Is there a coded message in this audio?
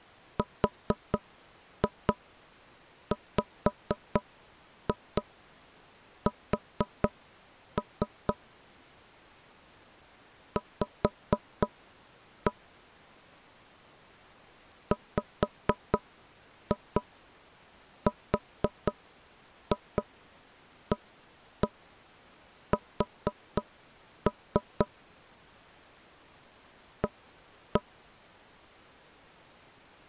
Yes: tap code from 0.4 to 27.8 s, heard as knocks on wood, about 4 knocks a second. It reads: RWS V WRAS A